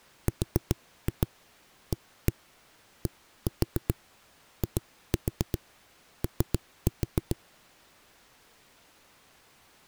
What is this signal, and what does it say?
Tap code, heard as knocks on a wall, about 7 knocks a second. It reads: RADIO